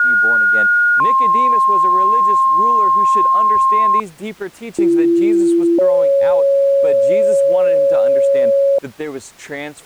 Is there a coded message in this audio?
Yes: two-tone page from 0.0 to 8.8 s, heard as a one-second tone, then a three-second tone, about 1430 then 1060 Hz, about 340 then 550 Hz, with speech in English.